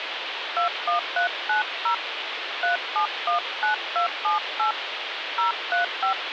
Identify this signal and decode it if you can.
DTMF, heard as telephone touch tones, dialled by hand, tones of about 120 ms, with phone line noise. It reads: 21390 3719278 035